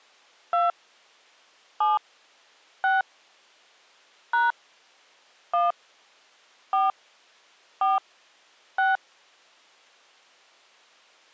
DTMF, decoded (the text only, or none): 2 7 6 # 1 4 4 6